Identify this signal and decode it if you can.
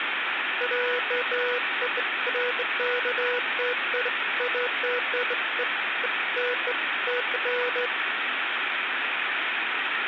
Beeps of irregular length, with phone line noise and room echo. There is no code.